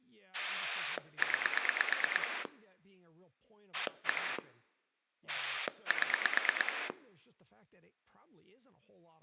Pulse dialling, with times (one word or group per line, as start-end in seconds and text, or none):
0.3-2.5 9
3.7-4.4 1
5.3-6.9 7